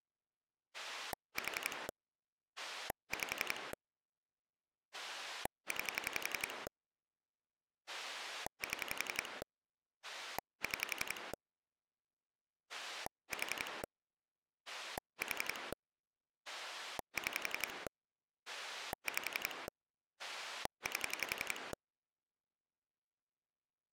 Pulse dialling, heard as a rotary dial, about 11 pulses a second. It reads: 4 5 9 7 6 4 4 6 5 8